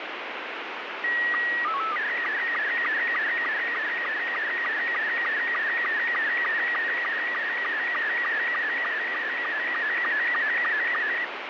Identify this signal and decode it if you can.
SSTV (slow-scan television), Robot 72, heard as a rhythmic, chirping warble, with heavy radio static.